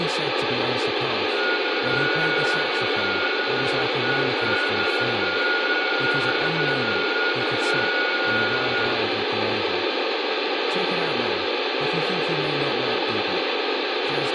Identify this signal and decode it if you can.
FT8 (several signals at once), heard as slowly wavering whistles, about 6.25 baud, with radio static, room echo and speech in English.